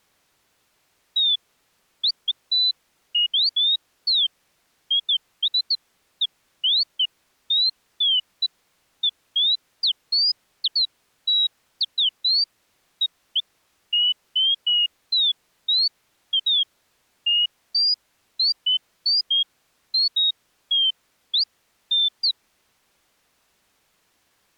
Bird-like chirps. There is no code.